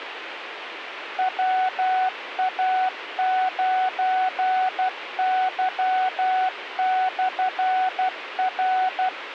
Morse code, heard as a keyed tone, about 12 wpm, 750 Hz, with radio hiss. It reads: WA9Y/R